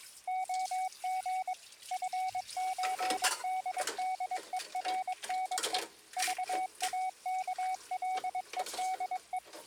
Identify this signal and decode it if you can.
Morse code (with Danish letters), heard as a keyed tone, machine-sent, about 22 wpm, 750 Hz, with kitchen noise. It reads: OG FØDDERNE VAKLEDE